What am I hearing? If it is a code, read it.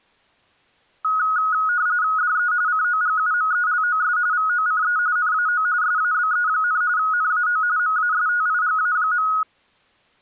RTTY (45.45 baud, 170 Hz shift), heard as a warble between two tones, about 1360 Hz centre. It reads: DE COGUMELOS VOCE NAO SABE, NAO MASTIGA.